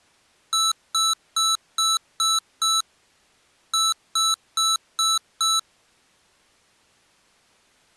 Beep code, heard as beeps from a small speaker, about 1320 Hz. 6-5.